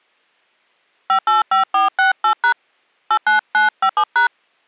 DTMF, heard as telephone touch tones, dialled by hand, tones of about 110 ms. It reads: 585468# 89957#